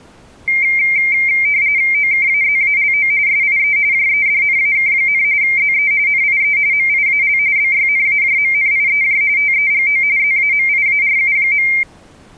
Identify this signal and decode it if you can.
RTTY (45.45 baud, 170 Hz shift), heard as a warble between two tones, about 2200 Hz centre. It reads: OKAZALO SIE JEDNAK, ZE NIE MIAL BYNAJMNIEJ TEGO ZAMIARU.